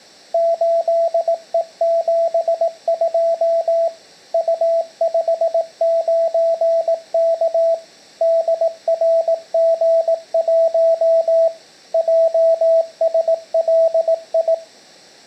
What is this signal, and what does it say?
Morse code, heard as a keyed tone, machine-sent, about 18 wpm, 660 Hz, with room echo. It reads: 8E72 U59K DRG1 JSLI